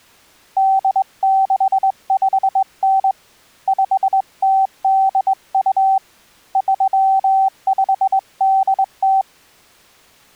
Morse code (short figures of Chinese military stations), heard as a keyed tone, hand-sent with a straight key, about 21 wpm, 770 Hz. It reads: 8659 5082 3580